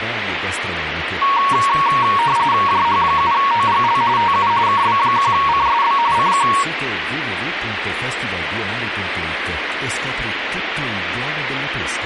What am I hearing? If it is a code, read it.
RTTY (45.45 baud, 170 Hz shift), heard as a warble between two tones, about 1020 Hz centre, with radio static. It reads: JH7OGL TU KB1CSB CQ